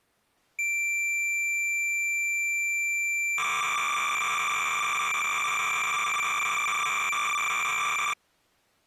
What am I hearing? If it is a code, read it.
Cassette data (Kansas City type), 300 baud, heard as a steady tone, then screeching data.